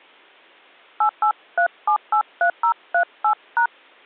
DTMF, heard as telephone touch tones, dialled by hand, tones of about 90 ms. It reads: 883783038#